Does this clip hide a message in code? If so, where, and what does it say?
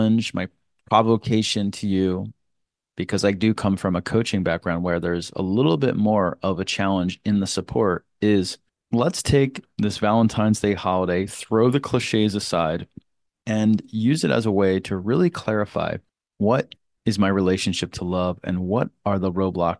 No, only speech in English.